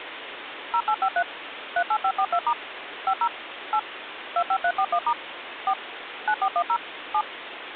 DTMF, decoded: 0853 38542* 50 8 25341* 4 9410 7

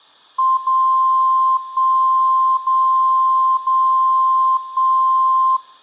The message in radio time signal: 0 1 0 0 1

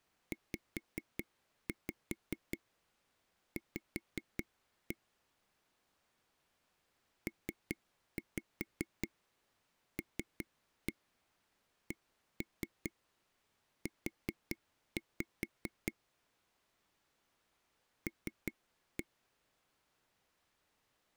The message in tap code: ZV PLCU L

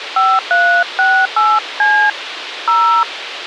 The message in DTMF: 5368C 0

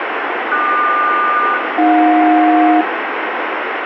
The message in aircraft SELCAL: QS-AJ

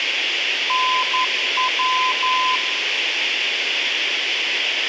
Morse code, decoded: NW

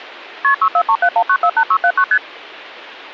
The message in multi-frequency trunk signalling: KP 64371948679 ST

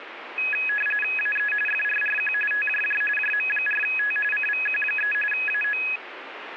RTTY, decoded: AE FRRQ TJJ JM4T CVQ3 AO

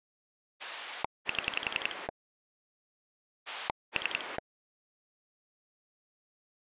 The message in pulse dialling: 7 3

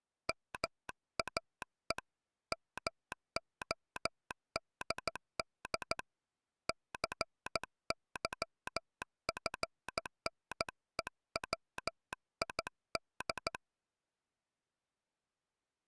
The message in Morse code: MAE MODD CYFNEWID

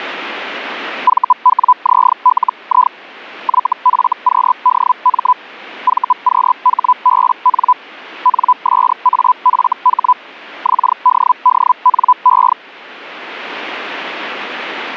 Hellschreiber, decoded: VWZLI YFQDM VQHBN NSAFH XDDNE

